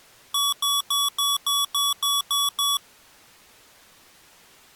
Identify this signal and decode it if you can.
Beep code, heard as beeps from a small speaker, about 1140 Hz. 9 short. In AMI BIOS tables: ROM checksum failure.